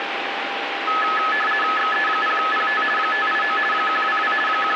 RTTY (50 baud, 450 Hz shift), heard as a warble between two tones, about 1500 Hz centre, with radio static and a steady whistle near 800 Hz. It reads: XE0PT 589 122 …